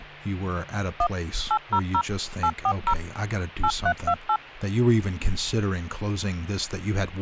DTMF, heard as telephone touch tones, dialled by machine, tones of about 70 ms, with speech in English. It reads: 1 800 840 8328